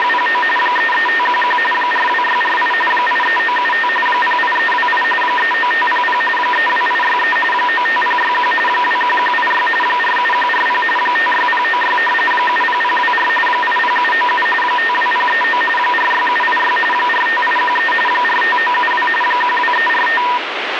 RTTY (45.45 baud, 850 Hz shift), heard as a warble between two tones, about 1400 Hz centre, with radio static. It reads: … 33511 42648 83975 08328 39500 32863 95061 21186 47140 56096 70024 80797 52039 46786 45813 45972 12345